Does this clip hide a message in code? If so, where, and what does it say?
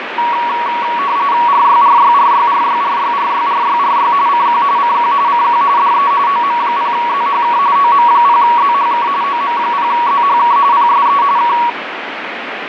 Yes: RTTY (45.45 baud, 170 Hz shift) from 0.2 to 11.7 s, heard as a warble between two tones, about 1040 Hz centre, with radio static and fading. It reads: RYRYRYRYRYRYRYRY CQ CQ CQ DE OM0ZHK OM0ZHK OM0ZHK PSE K